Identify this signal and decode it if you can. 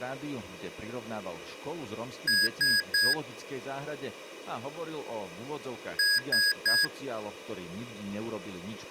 Beep code, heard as beeps from a small speaker, played twice, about 1650 Hz, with speech in Slovak. 3 short. In AMI BIOS tables: failure in the first 64 KB of memory; in Dell tables: chipset error.